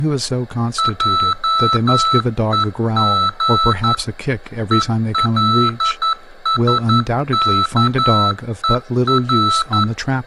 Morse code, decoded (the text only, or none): JEG ELSKER